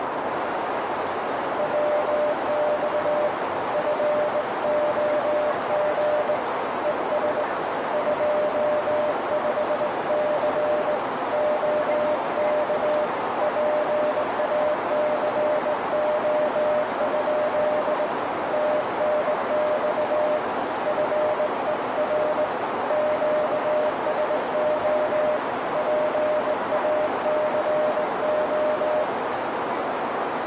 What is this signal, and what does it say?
Morse code, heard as a keyed tone, hand-sent with a straight key, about 19 wpm, 600 Hz, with heavy radio static and a narrow filter. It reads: WX FOG ES 25C OK PACO? TNX FER QSO PACO